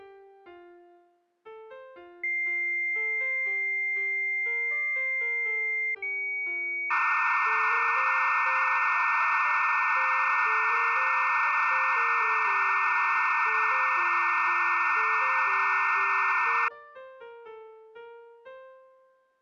Dial-up modem handshake (low-speed, two carriers), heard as two whistles, then hiss.